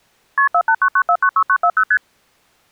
Multi-frequency trunk signalling (R1, as on North American trunks), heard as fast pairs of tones, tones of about 70 ms. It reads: KP 4899496940 ST